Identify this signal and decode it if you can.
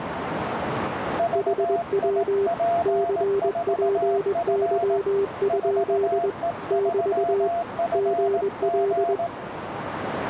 Morse code, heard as two keyed tones, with radio static and a narrow filter. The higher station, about 18 wpm, 690 Hz: VIP4F 4E3FG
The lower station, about 21 wpm, 400 Hz: HW CPY? <BT> GL